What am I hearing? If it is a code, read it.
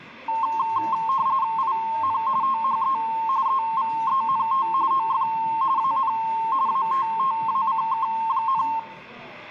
RTTY (45.45 baud, 170 Hz shift), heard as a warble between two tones, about 980 Hz centre, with the noise of a crowd indoors. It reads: IN THE EVENT OF AN ATTACK,